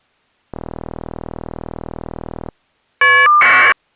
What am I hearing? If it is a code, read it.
Caller ID data burst, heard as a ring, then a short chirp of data, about 1200 baud.